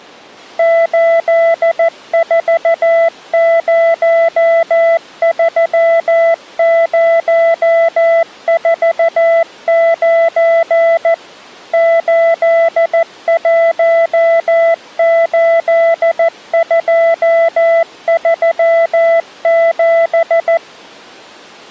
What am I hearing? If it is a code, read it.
Morse code, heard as a keyed tone, machine-sent, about 14 wpm, 670 Hz. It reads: 8403049 818237